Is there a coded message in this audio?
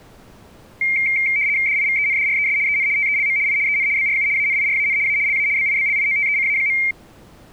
Yes: RTTY (75 baud, 170 Hz shift) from 0.8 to 6.9 s, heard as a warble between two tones, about 2200 Hz centre. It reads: DIVENDRES EN TELM I EN BRU ANIRAN A LA BIBLIOTECA.